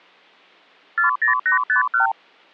Multi-frequency trunk signalling (R2, with the far end's replies), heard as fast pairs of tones, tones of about 120 ms. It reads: 40851